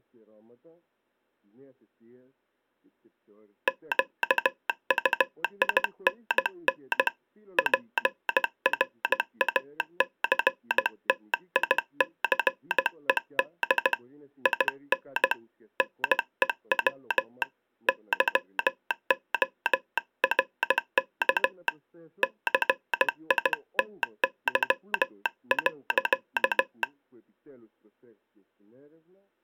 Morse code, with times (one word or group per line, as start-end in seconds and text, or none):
3.7-7.1 QUINN
7.6-13.9 PRACTICED
14.5-15.3 IN
15.8-17.4 NEW
17.9-21.7 YORK
22.2-26.8 CITY.